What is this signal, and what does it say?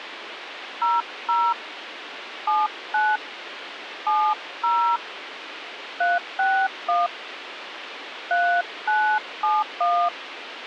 DTMF, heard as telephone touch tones, dialled by hand, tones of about 270 ms, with radio hiss. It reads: 00 79 70 361 3971